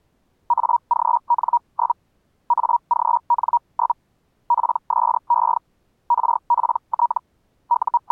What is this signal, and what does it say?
Hellschreiber (Feld-Hell, 122.5 baud), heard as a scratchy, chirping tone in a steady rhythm, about 950 Hz. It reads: AGN? AGN? PSE RPT …